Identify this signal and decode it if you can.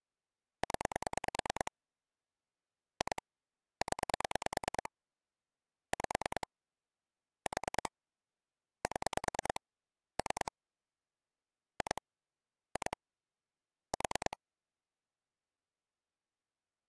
Pulse dialling, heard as clicks on a phone line, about 9 pulses a second. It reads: 0 2 0 5 4 7 3 2 2 4